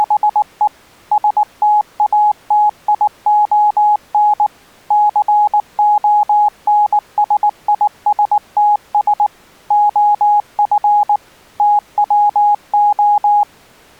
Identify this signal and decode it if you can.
Morse code, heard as a keyed tone, machine-sent, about 19 wpm, 840 Hz. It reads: … STATION CONSISTS OF TWO